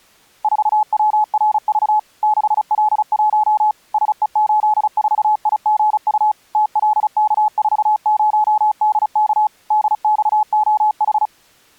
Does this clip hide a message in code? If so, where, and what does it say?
Yes: Morse code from 0.4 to 11.3 s, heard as a keyed tone, machine-sent, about 35 wpm, 850 Hz. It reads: 4WRV 6L1 SE84IGU TLK40DK DXOH